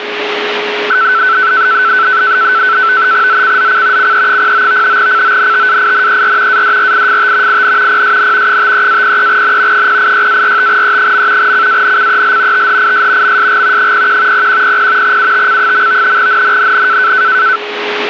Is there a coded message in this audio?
Yes: NAVTEX (SITOR-B), 100 baud, 170 Hz shift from 0.9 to 17.6 s, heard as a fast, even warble, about 1420 Hz centre, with radio static and a steady whistle near 420 Hz. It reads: ZCZC CE09 CONTAINER ADRIFT IN PSN 53-03N 086-45E. CANCEL THIS MSG 01 0100 UTC. NNNN